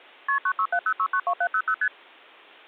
Multi-frequency trunk signalling (R1, as on North American trunks), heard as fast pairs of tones, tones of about 70 ms. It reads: KP 9670692700 ST